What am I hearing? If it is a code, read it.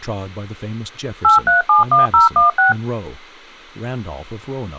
DTMF, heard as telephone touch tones, dialled by machine, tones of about 140 ms, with speech in English. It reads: 8371016